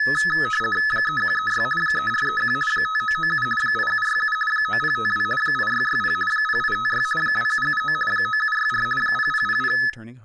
RTTY (50 baud, 450 Hz shift), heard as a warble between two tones, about 1500 Hz centre, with room echo and speech in English. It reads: 3136 3431 5997 8767 9052 8660 0856 2779 9764 0000